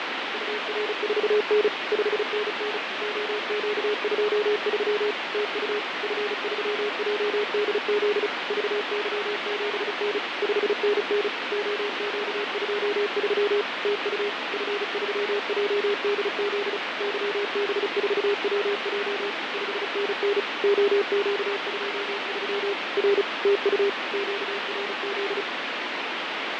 Morse code, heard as a keyed tone, machine-sent, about 35 wpm, 410 Hz, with heavy radio static and fading. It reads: UR4N 5NN OQ23 TU F3JDZ VY7N 5NN OQ23 TU F3JDZ YB4WJ 5NN OQ23 R TU QRZ